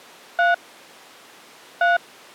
DTMF, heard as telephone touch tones, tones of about 160 ms. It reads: 3 3